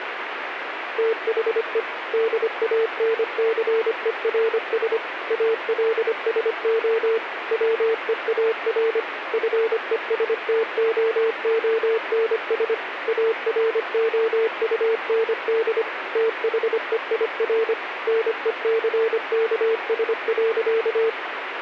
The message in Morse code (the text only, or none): THE DANCERS ALSO WEAR FESTOONS AROUND THEIR NECKS.